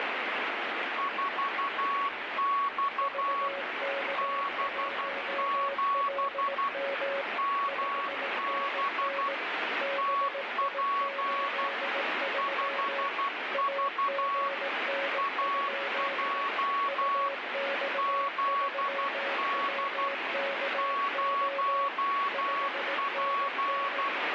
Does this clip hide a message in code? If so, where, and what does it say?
Yes: Morse code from 0.9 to 24.1 s, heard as two keyed tones, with heavy radio static. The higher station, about 12 wpm, 1120 Hz: 4X B7 MB TP 5V AJ ZD 0P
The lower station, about 18 wpm, 550 Hz: VK1LM 5NN BI83 AGN? UX3WKO 5NN